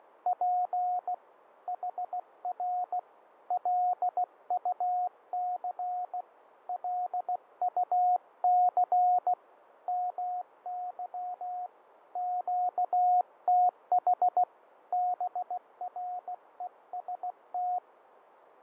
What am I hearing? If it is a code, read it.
Morse code, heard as a keyed tone, hand-sent with a bug key, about 16 wpm, 720 Hz, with radio static and fading. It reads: … HR LUC LUC MY QTH BREST